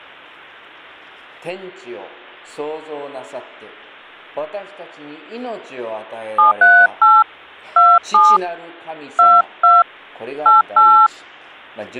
DTMF, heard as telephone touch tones, dialled by hand, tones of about 220 ms. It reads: 738 27 22 88